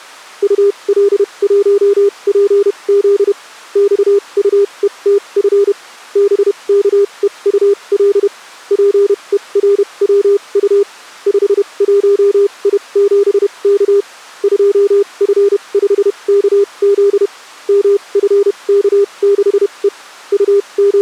Morse code, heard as a keyed tone, machine-sent, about 31 wpm, spaced as for 25 wpm, 400 Hz. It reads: UL1PZ XUETF BKEUL PERWU 51I7K 2F5KZ MFK6E …